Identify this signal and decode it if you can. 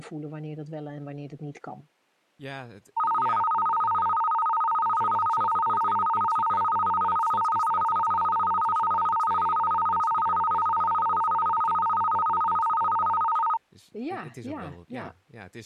A tone that alternates evenly between two pitches, with speech in Dutch. There is no code.